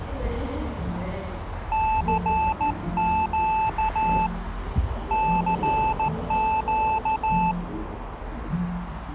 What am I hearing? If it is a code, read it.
Morse code, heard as a keyed tone, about 14 wpm, 880 Hz, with radio static and the noise of a cafe. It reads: CQ CQ